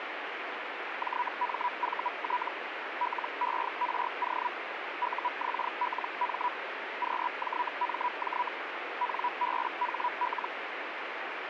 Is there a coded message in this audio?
Yes: Hellschreiber (Feld-Hell, 122.5 baud) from 1.0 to 10.5 s, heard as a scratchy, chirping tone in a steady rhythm, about 980 Hz, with radio static. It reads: JMVT LERO UXLM QJMJ NBHL